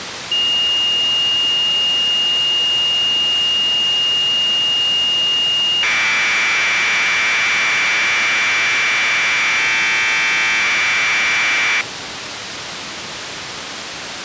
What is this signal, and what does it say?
Commodore tape loading (standard loader), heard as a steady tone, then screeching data, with tape hiss.